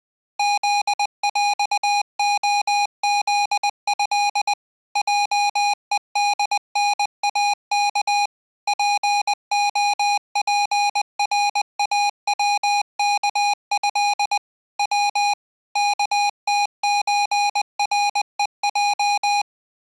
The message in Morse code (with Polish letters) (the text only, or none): ZŁOZĘ JEDNAK POPRAWKĘ W KTÓREJ